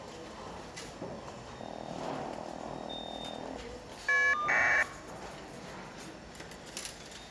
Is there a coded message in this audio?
Yes: caller ID data burst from 1.6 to 4.8 s, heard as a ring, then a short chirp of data, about 1200 baud, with the noise of a restaurant.